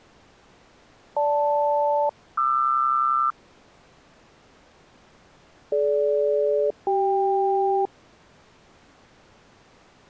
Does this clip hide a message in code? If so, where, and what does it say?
Yes: aircraft SELCAL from 1.2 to 7.9 s, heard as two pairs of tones. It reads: GL-QR DG-CK